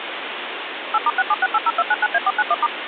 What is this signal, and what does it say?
DTMF, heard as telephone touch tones, dialled by machine, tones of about 40 ms, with phone line noise. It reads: 8*67680299A491*